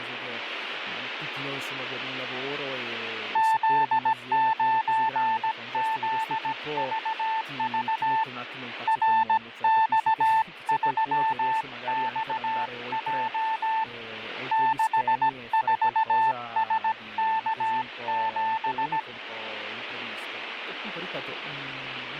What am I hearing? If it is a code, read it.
Morse code, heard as a keyed tone, hand-sent with a paddle, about 17 wpm, 890 Hz, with radio static and speech in Italian. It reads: Z9ZVV RX3XJ 64SK7